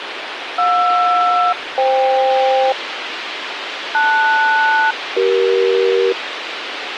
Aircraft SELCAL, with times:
0.6-2.7 JR-FK
3.9-6.1 LS-CE

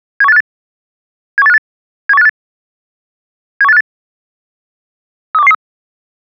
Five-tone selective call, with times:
0.2-0.4 71858
1.4-1.6 71858
2.1-2.3 71858
3.6-3.8 71858
5.3-5.5 32113

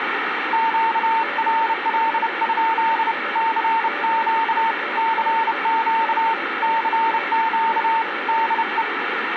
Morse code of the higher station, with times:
0.5-3.1 QRL?
3.4-4.7 CQ
5.0-6.3 CQ
6.6-8.0 CQ
8.3-8.8 DE

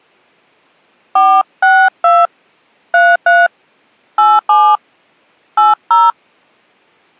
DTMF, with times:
1.2-2.3 462
2.9-3.5 33
4.2-4.8 87
5.6-6.1 80

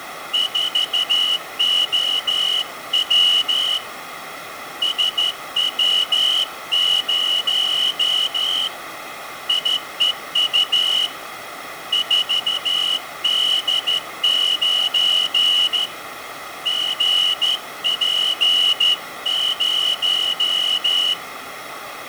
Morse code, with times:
0.3-3.8 4OW
4.8-8.7 SW0
9.5-11.1 IEU
11.9-15.9 4D9
16.7-21.1 GP0

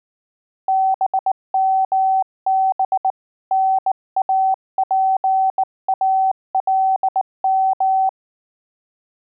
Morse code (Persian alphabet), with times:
0.7-3.1 بمب
3.5-8.1 ناپالم

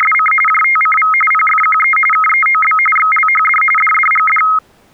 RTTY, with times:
0.0-0.3 …
0.5-1.1 JTCV
1.3-2.0 PFQE
2.1-2.8 KEOB
3.0-3.6 XLHD
3.8-4.4 DDGD

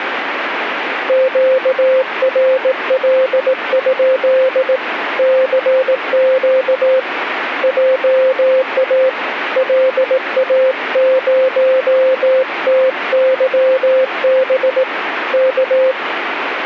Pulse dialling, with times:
none

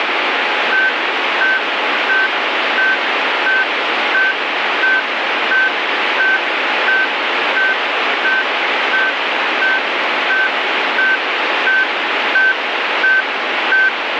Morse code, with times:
none

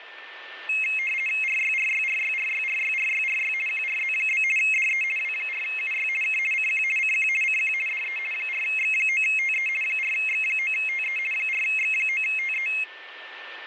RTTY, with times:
1.4-3.5 RYRYRYRYRYRYRY
3.7-4.4 QRZ?
4.6-5.0 DE
5.2-6.1 W4UY
6.2-6.4 K
6.5-6.8 CQ
7.0-7.3 CQ
7.4-7.7 CQ
7.9-8.2 DE
8.3-9.7 4X9TE
9.8-11.2 4X9TE
11.3-12.7 4X9TE

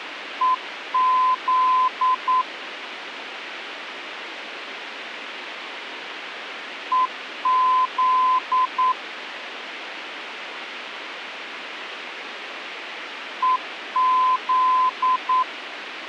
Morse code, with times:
0.4-2.4 EZ
6.9-8.9 EZ
13.4-15.4 EZ

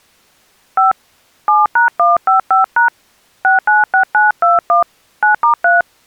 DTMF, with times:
0.8-0.9 5
1.5-2.9 7#155#
3.4-4.8 696921
5.2-5.8 9*3

